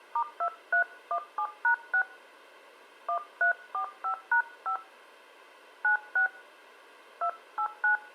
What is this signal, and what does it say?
DTMF, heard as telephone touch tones, dialled by hand, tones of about 100 ms. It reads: *2317#6 1345#5 96 289